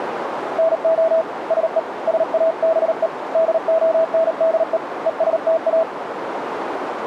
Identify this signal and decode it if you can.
Morse code, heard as a keyed tone, hand-sent with a paddle, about 38 wpm, 650 Hz, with radio static and a narrow filter. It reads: NO SE SABE DONDE ESTA